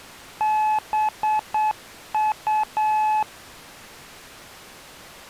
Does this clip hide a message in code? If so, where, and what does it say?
Yes: Morse code (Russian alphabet) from 0.3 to 3.3 s, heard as a keyed tone, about 8 wpm, 860 Hz. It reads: БУ